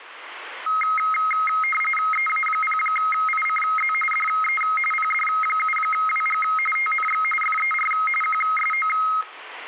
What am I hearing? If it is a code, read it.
RTTY (45.45 baud, 850 Hz shift), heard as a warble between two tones, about 1700 Hz centre. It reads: EA0ICZ DE PD7WG TNX FER QSO